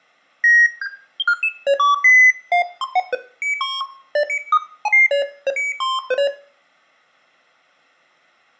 Electronic bleeps of random pitch and length, with room echo. There is no code.